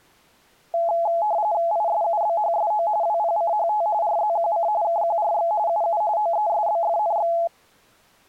RTTY (45.45 baud, 170 Hz shift), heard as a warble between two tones, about 760 Hz centre. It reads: ISUBHSO WPCHT RZQC KQRX UU OESBFNX